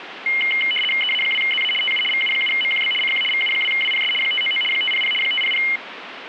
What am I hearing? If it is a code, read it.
RTTY (75 baud, 850 Hz shift), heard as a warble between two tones, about 2550 Hz centre, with radio static. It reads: EA2ZA TU VU7MQB CQ VU2WPS 599 500 500